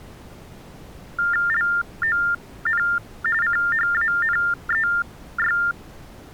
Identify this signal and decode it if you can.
TTY/TDD text telephone tones (45.45 baud Baudot), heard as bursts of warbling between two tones, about 400 Hz shift, 1600 Hz centre. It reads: LON CHANEY